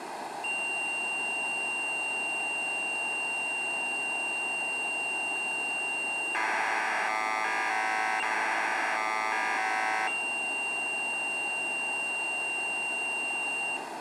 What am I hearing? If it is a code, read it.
Commodore tape loading (standard loader), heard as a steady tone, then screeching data, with tape hiss.